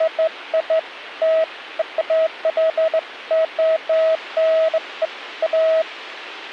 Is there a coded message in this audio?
No, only beeps of irregular length, with a squelch burst at the end.